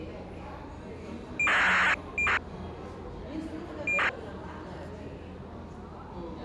ACARS aircraft data, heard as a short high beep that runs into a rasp, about 2400 baud, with the noise of a cafe.